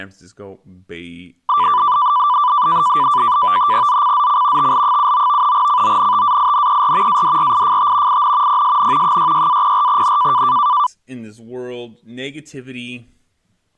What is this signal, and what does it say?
NAVTEX (SITOR-B), 100 baud, 170 Hz shift, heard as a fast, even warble, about 1080 Hz centre, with speech in English. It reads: ZCZC TL79 CONTAINER ADRIFT IN PSN 66-04N